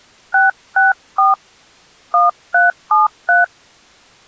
DTMF, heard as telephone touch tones, dialled by hand, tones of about 160 ms. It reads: 664 1373